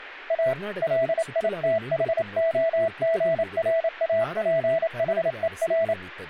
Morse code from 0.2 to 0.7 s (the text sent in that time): A